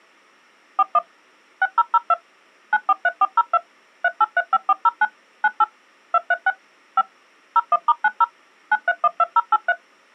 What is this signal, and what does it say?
DTMF, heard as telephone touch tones, dialled by machine, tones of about 40 ms. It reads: 41 6002 943402 3835409 98 236 5 01*90 9312083